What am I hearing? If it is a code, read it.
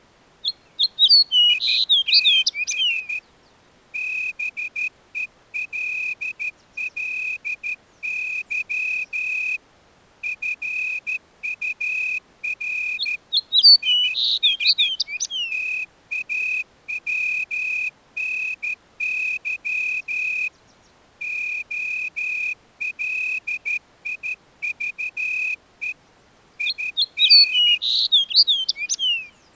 Morse code, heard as a whistle, hand-sent with a straight key, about 13 wpm. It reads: ITS BELLY FUR IS TAWNY OLIVE IN